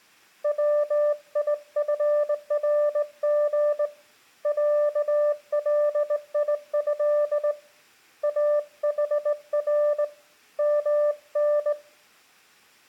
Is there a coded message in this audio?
Yes: Morse code (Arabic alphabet) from 0.4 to 11.8 s, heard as a keyed tone, hand-sent with a straight key, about 19 wpm, 590 Hz. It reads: ويفرغ عليه احر من